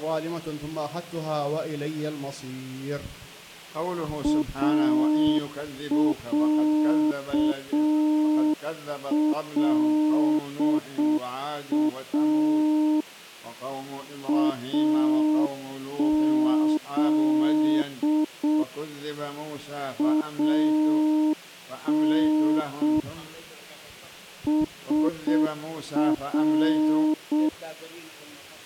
Morse code (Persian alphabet), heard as a keyed tone, hand-sent with a straight key, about 6 wpm, 310 Hz. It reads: اصلا از ان سر